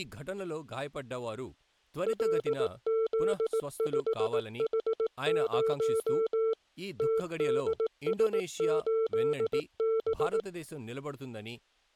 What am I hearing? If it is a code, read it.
Morse code, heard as a keyed tone, machine-sent, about 18 wpm, 450 Hz, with speech in Telugu. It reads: LZ5H0 TDS8B